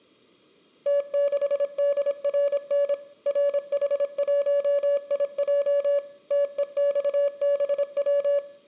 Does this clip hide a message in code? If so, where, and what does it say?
Yes: Morse code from 0.8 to 8.4 s, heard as a keyed tone, machine-sent, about 26 wpm, 570 Hz, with room echo. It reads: T6DRN RH1IJ TEXBW